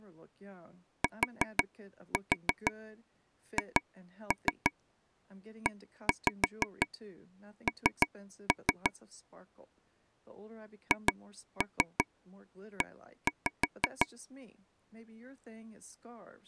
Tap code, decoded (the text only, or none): THEN HE